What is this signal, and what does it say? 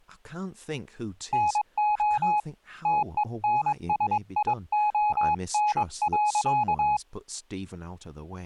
Morse code, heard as a keyed tone, hand-sent with a paddle, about 22 wpm, 840 Hz, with speech in English. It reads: NO TENSION.